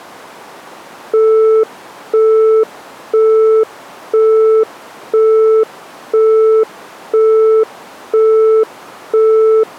Telephone call progress tone (single-tone plan, as in Europe, Japan and elsewhere), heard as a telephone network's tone, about 440 Hz, 0.5 s on and 0.5 s off. Busy tone.